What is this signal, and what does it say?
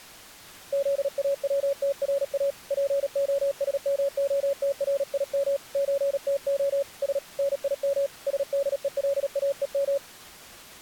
Morse code (Russian alphabet), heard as a keyed tone, hand-sent with a paddle, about 37 wpm, 560 Hz. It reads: ЗАВТРА ПОСМОТРИМ ЧТО С НИМ СДЕЛАЕМ